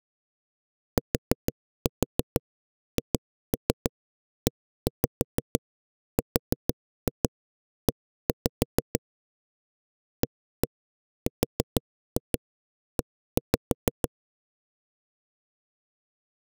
Tap code, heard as knocks on a wall, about 6 knocks a second. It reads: THERE ARE